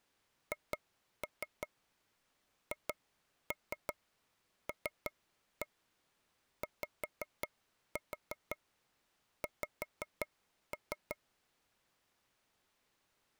Tap code, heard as taps on a table, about 5 knocks a second. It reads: HHLYX